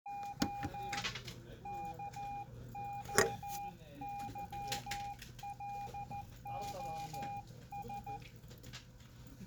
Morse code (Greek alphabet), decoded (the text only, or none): Ο ΚΟΥΛΟΣ